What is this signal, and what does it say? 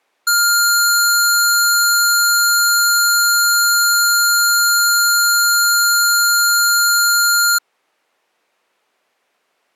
A steady tone. There is no code.